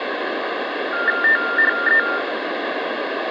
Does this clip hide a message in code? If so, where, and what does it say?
Yes: TTY/TDD text telephone tones (45.45 baud Baudot) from 0.9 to 2.2 s, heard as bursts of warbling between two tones, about 400 Hz shift, 1600 Hz centre, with phone line noise. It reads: THE